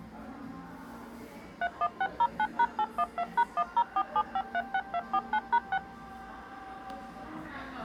DTMF, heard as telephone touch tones, dialled by machine, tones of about 60 ms, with the noise of a crowd indoors. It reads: 31609#812#1047536249#6